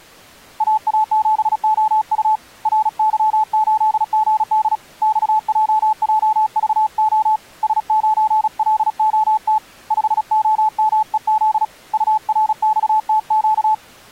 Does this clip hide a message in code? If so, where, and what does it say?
Yes: Morse code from 0.5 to 13.8 s, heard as a keyed tone, hand-sent with a paddle, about 36 wpm, 870 Hz. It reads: AA7OU RY8GD XJJVO S9LOT 5OMEZ URXTQ